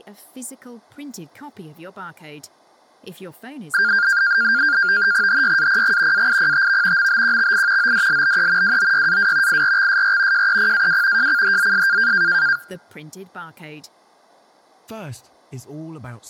NAVTEX (SITOR-B), 100 baud, 170 Hz shift, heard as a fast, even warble, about 1500 Hz centre, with speech in English. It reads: HYAPG AIPTV MBQXI ODLBE WOYAW IRXSR JEPAW JCHZS